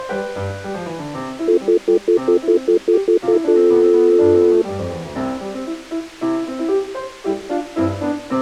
Telephone call progress tone (North American plan), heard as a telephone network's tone, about 350, 440 Hz, 0.1 s on and 0.1 s off. Stutter dial tone.